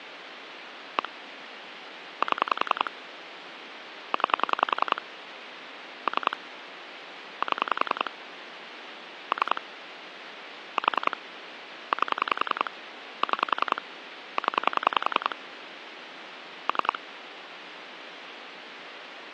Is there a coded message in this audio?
Yes: pulse dialling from 1.0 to 17.0 s, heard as clicks on a phone line, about 10 pulses a second, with phone line noise. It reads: 1 7 9 3 7 3 4 8 6 0 3